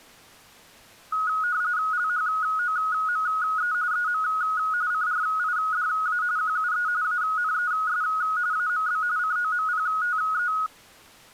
RTTY (45.45 baud, 170 Hz shift), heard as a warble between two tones, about 1360 Hz centre. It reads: LHOME EM CRIDA QUE ANES AMB COMPTE